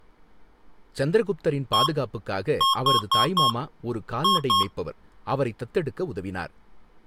Beep code, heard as beeps from a small speaker, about 1080 Hz, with speech in Tamil. 1-4-2. In Phoenix BIOS tables: parity failure in the first 64 KB of memory.